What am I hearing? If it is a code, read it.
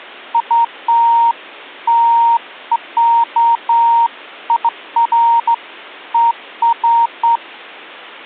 Beeps of irregular length. There is no code.